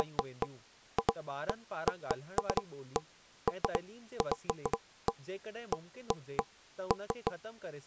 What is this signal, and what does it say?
Irregular knocks on wood, with speech in Sindhi. There is no code.